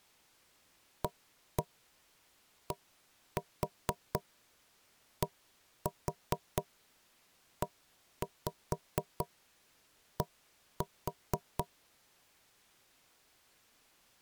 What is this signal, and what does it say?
Tap code, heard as knocks on wood, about 4 knocks a second. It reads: ADDED